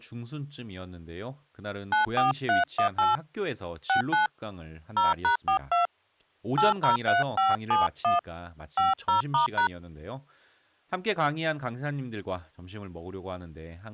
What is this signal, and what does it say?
DTMF, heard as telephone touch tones, dialled by hand, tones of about 140 ms, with speech in Korean. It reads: 94318 69 0#42 803571 50*#